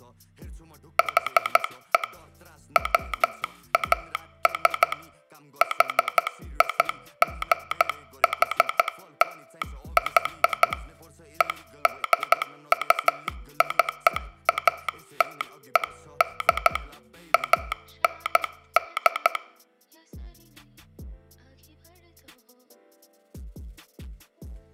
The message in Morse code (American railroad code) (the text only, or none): HE WAS HIGHLY EDUCATED AND